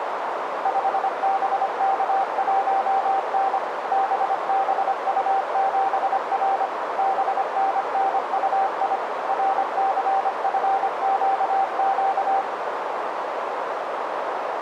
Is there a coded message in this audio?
Yes: Morse code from 0.6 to 12.5 s, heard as a keyed tone, machine-sent, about 25 wpm, 780 Hz, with heavy radio static and a narrow filter. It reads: 5BK1N BBU7R BNNUI RCFQQ